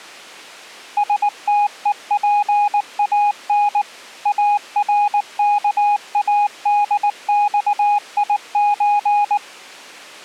Morse code (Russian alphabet), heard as a keyed tone, machine-sent, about 19 wpm, 820 Hz. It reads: СТЕПАН АРКАДЬИЧ